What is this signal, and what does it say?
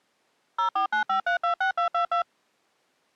DTMF, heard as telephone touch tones, dialled by machine, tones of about 110 ms. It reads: 0495326222